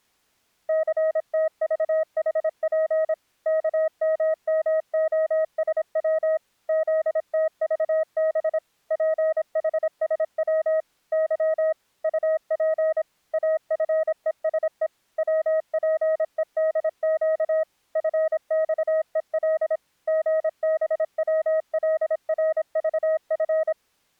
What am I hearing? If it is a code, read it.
Morse code, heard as a keyed tone, machine-sent, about 26 wpm, 630 Hz. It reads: CTVHP KMMOSW ZTVB PHSW Y UP AFESE WPEDQ FXEL GBWLRVF